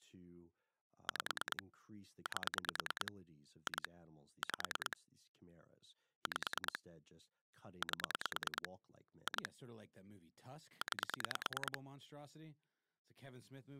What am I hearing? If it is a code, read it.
Pulse dialling, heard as clicks on a phone line, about 9 pulses a second, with speech in English. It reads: 5 8 2 5 5 8 2 9